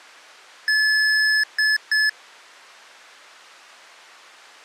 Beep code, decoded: 1 long, 2 short

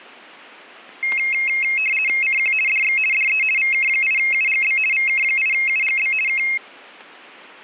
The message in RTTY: CQ DX DE VK8UGB VK8UGB K

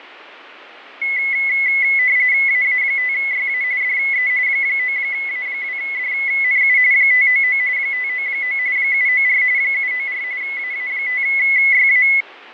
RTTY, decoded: AA5YA DE 9A2DNU 599 599 794 794 AA5YA

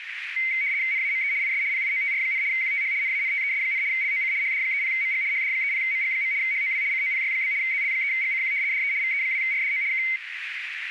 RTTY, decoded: NAME IS PIOTR, QTH NANTES, LOC HD30MG HD30MG. HOW COPY? ZL3GCQ DE VE2RDO K

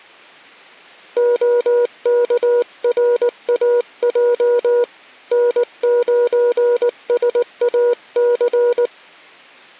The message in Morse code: OKRAJ N9SAC

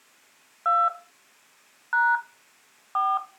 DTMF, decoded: 2 # 4

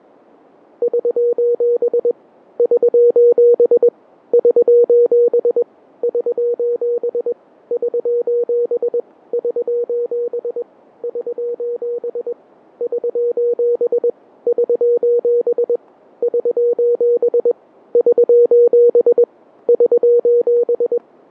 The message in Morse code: <SOS> <SOS> <SOS> <SOS> <SOS> <SOS> <SOS> <SOS> <SOS> <SOS> <SOS> <SOS>

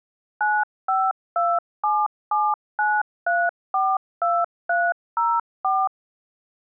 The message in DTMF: 952779342304

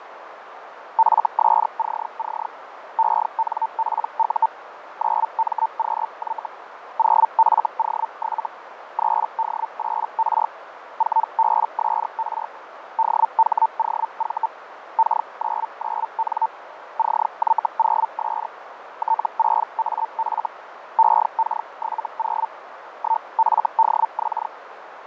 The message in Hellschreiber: FSCC ENPU 9MQY 0FO7 3D8R 4BSR DHOV K99N CY0S T6AF EK70 1FDX

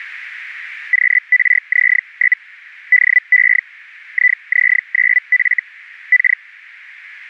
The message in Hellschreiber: QRZ? DE IZ9F K

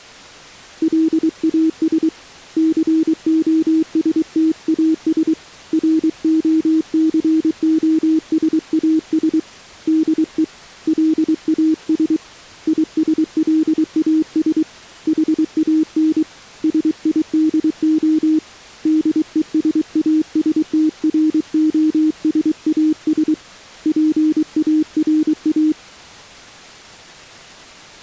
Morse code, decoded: LAS COSTAS ROCOSAS DE LAS ISLAS HAN SIDO DESASTROSAS PARA

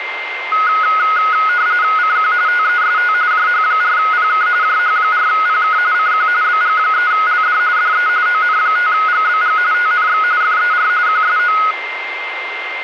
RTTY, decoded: CQ TEST JH4PK JH4PK CQ BG3LD DE ON5GBG TNX FER QSO

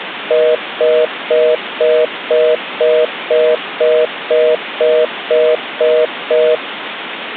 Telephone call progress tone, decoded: congestion tone

